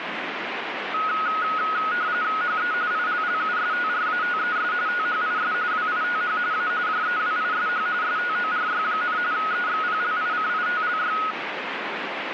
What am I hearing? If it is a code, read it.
RTTY (45.45 baud, 170 Hz shift), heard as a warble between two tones, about 1360 Hz centre, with radio static. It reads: HE ILLUSTRATES THIS WITH A JEWISH STORY, EXPLICITLY